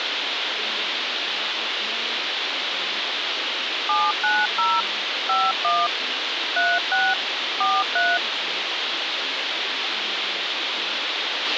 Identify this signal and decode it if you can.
DTMF, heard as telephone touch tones, dialled by hand, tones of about 220 ms, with radio hiss, a squelch burst at the end and speech in English. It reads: 790 51 36 43